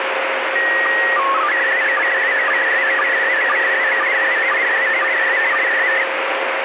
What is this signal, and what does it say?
SSTV (slow-scan television), PD 120, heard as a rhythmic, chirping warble, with heavy radio static.